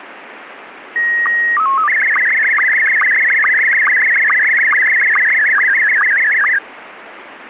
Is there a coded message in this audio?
Yes: SSTV (slow-scan television), Scottie S1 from 1.0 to 6.6 s, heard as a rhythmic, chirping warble, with radio static.